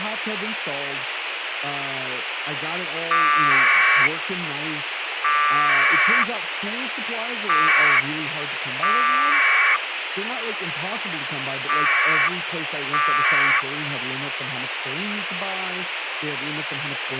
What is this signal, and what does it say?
Packet radio (AX.25, as in APRS), 1200 baud, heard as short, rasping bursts, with radio hiss and speech in English.